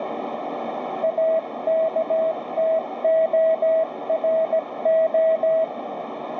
Morse code, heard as a keyed tone, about 17 wpm, 650 Hz, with radio static and a narrow filter. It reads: AKTORO